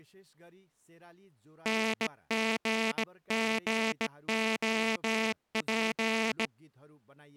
Morse code, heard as a buzzer, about 18 wpm, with speech in Nepali. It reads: NGGOP